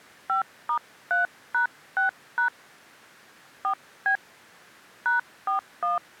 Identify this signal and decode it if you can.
DTMF, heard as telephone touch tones, dialled by hand, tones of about 120 ms. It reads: 5*3#6# 4B #41